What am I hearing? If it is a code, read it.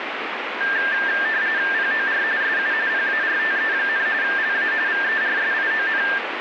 RTTY (45.45 baud, 170 Hz shift), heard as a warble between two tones, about 1700 Hz centre, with radio static. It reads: POR SU PARTE, LA VERSION